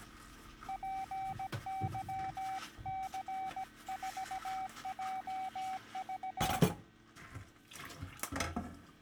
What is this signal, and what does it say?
Morse code, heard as a keyed tone, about 17 wpm, 760 Hz, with kitchen noise. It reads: PYC4JV